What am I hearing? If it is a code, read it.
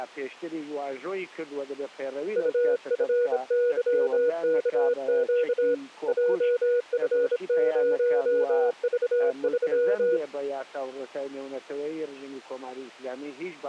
Morse code, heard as a keyed tone, hand-sent with a bug key, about 26 wpm, 480 Hz. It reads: UFYKQ JF0V3